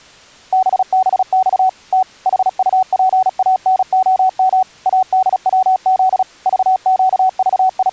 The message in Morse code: BBX T HUPANOM ADWZ …

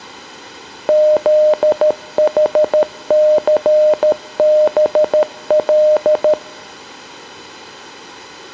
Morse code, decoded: ZHCBL

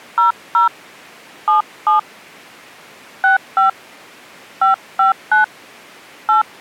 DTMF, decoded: 00 77 65 559 8

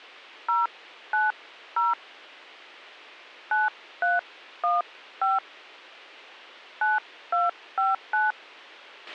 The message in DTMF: 090 9315 9259

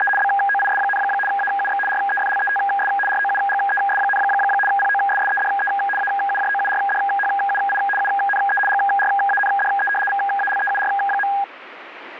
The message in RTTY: … BOIS, AUX REFLETS ROUGES, POSSEDE AUJOURDHUI UNE GRANDE VALEUR.

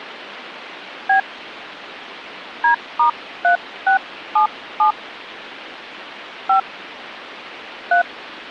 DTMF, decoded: B D*3677 5 3

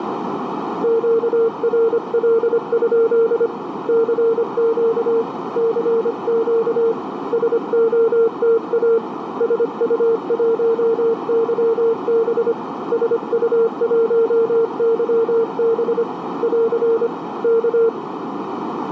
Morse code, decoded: QRL? CQ CQ SOTA SU1YB SU1YB <AR> K

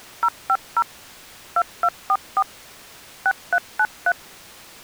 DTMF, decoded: 050 2244 6393

